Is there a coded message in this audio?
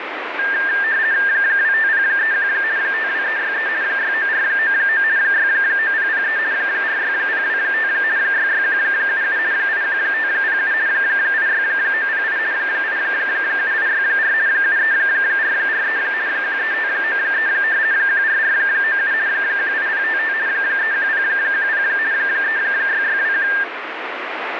Yes: RTTY (50 baud, 170 Hz shift) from 0.4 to 23.6 s, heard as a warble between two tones, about 1700 Hz centre, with radio static. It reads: 25031 52363 69499 69003 46025 66177 81507 86908 87864 73443 13593 14497 18055 31010 36621